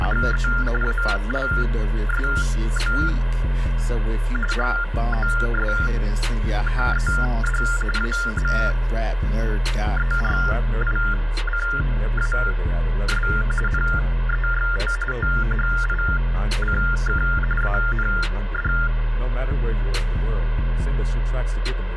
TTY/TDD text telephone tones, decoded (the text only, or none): … ALSO HOSTED AMERICAS NEXT THICK AND